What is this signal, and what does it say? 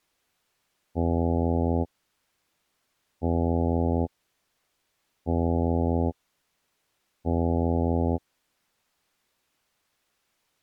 Ship horn signal, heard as a ship's horn, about 80 Hz. 4 short. At sea: a pilot vessel's identity signal in fog.